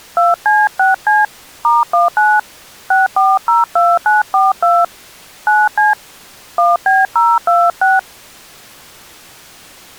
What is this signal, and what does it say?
DTMF, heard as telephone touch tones, dialled by hand, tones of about 190 ms. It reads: 2C6C *19 6402942 9C 1B026